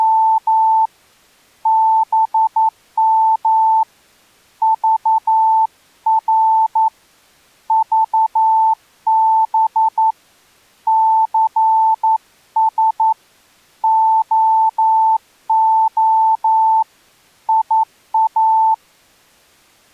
Morse code, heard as a keyed tone, hand-sent with a paddle, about 11 wpm, 890 Hz. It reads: … BM VR VB CS OO IA